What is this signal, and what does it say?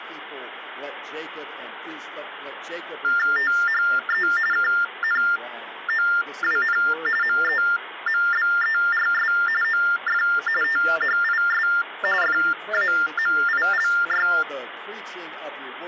TTY/TDD text telephone tones (45.45 baud Baudot), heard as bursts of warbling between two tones, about 400 Hz shift, 1600 Hz centre, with phone line noise. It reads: THE KNOWN MEMBERS OF THIS FAMILY